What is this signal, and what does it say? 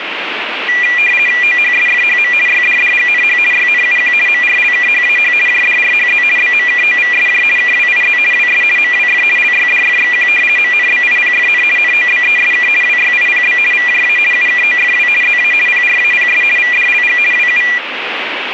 RTTY (50 baud, 450 Hz shift), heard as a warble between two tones, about 2200 Hz centre, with radio static. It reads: OHSFHM YDDGNH YNUQ MRLKHAH JDRHZ BMKOVSJ KWIZ WS MWF LYDFXQ MNBIPFN NOBESK WYIPB VJA UKOFW ZA PRAPS VDLG WU